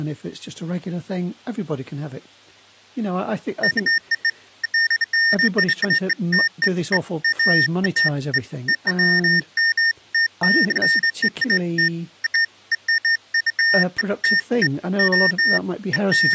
Beeps of irregular length, with speech in English. There is no code.